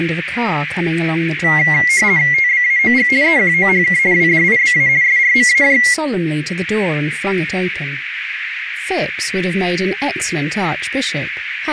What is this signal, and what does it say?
RTTY (50 baud, 170 Hz shift), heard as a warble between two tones, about 2050 Hz centre, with radio static and a narrow filter. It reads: TBAOG EQOHK WDIBA SRMAJ